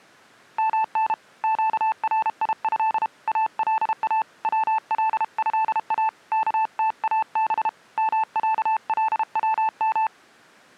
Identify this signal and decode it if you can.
Morse code (Arabic alphabet), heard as a keyed tone, hand-sent with a paddle, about 32 wpm, 880 Hz. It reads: من قريه الا ولها كتاب معلوم